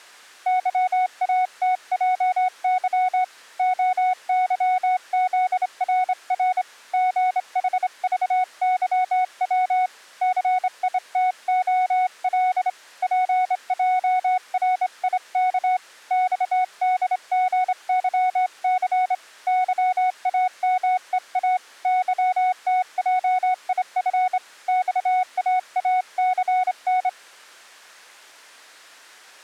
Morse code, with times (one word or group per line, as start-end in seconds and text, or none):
0.5-3.2 YATJY
3.6-6.6 OYZRR
6.9-9.9 GHVYW
10.2-12.7 CITOL
13.0-15.8 PJRIK
16.1-19.1 XDGYC
19.5-21.6 YAMEA
21.9-24.4 YTJIF
24.7-27.1 XAACN